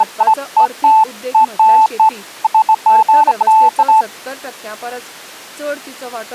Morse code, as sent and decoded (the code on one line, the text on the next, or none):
none